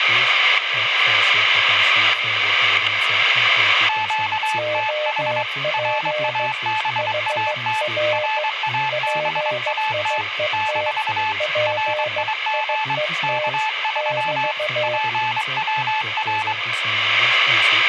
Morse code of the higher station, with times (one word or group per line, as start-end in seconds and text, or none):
3.9-5.4 QTH
5.7-7.8 RABAT
8.1-10.2 RABAT
10.5-11.3 -
11.7-12.9 RIG
13.2-14.5 K3
14.8-16.5 PWR